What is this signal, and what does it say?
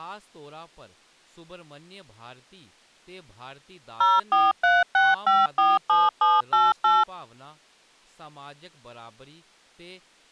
DTMF, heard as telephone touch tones, dialled by machine, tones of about 200 ms, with speech in Dogri. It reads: 0436547788